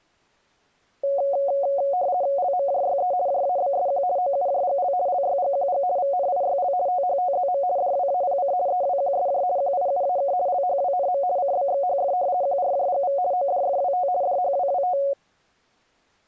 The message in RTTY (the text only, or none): LMJYE JABSQ OUJGL LYGQG VNIYL THTZM DWAPC EWQSJ QIUAK LHWNM CBXHF QRJGV ODFWT DHWWT